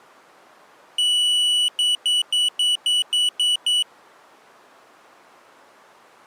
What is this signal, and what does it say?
Beep code, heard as a piezo beeper, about 2950 Hz. 1 long, 8 short. In AMI BIOS tables: display or retrace test failure.